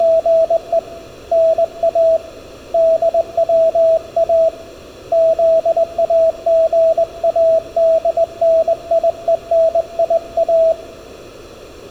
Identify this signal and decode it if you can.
Morse code, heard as a keyed tone, hand-sent with a straight key, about 20 wpm, 650 Hz. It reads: … NA DWA ZAGADNIENIA